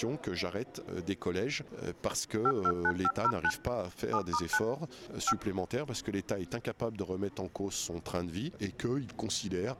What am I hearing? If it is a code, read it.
DTMF, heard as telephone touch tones, dialled by machine, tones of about 60 ms. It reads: 529509 7*9 5